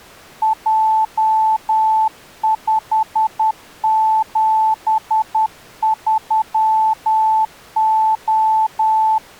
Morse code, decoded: J573O

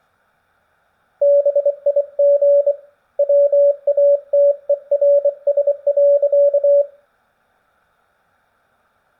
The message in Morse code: BIG WATERS.

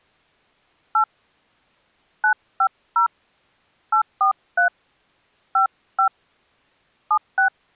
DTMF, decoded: 8 950 843 55 76

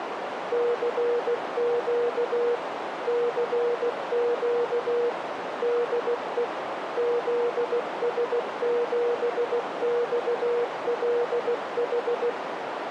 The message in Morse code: CQ CQ DE ZS7XLH

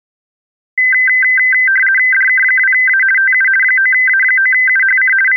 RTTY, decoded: DK2A TU 9A9UHC …

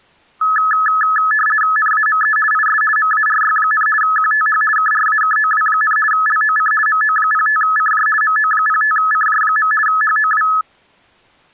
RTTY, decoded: NAME IS MARY, QTH KRAKOW, LOC MO05CJ MO05CJ. HOW

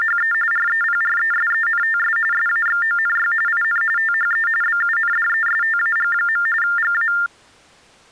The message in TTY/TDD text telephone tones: … REPRESENTS SAXONY IN THE BUNDESTAG. GA

